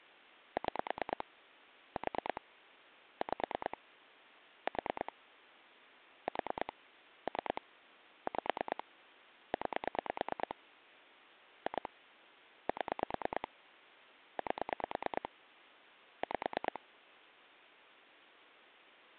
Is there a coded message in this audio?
Yes: pulse dialling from 0.6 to 16.8 s, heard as clicks on a phone line, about 9 pulses a second. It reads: 6 4 5 4 4 3 5 9 2 7 8 5